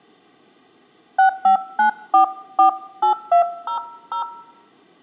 DTMF, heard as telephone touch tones, dialled by hand, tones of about 110 ms. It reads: 659448200